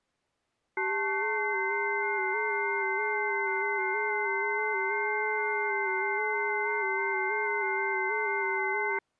FT8 (several signals at once), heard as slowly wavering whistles, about 6.25 baud.